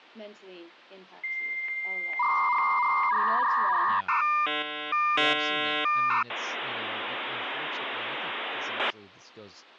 Dial-up modem handshake (V.34 or later), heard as a whistle, warbles, then hiss, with speech in English.